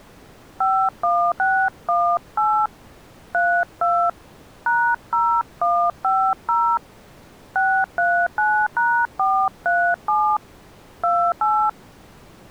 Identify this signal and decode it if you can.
DTMF, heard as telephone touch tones, dialled by hand, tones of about 280 ms. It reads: 51618 32 #0150 639#437 28